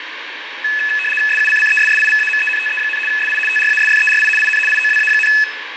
RTTY (75 baud, 850 Hz shift), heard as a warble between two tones, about 2150 Hz centre, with radio static and fading. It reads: SUCCESSIVAMENTE, SI TRASFERI IN IOWA,